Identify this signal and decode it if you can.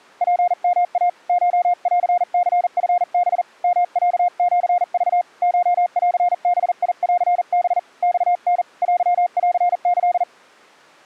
Morse code (Japanese Wabun code), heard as a keyed tone, hand-sent with a paddle, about 40 wpm, 710 Hz. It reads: ツヨイ コンニチハ ヨロシク コンバンハ マタ テンキ